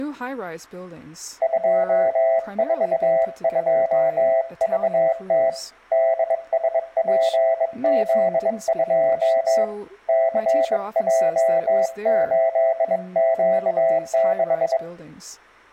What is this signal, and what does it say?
Morse code, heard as a keyed tone, hand-sent with a bug key, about 22 wpm, 660 Hz, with room echo and speech in English. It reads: 242VT DSPZ2 CJ8Q6